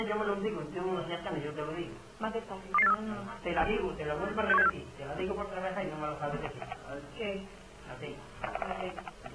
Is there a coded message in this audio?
Yes: five-tone selective call (EEA) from 2.7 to 4.7 s, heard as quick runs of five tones, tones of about 40 ms. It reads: 22843 61764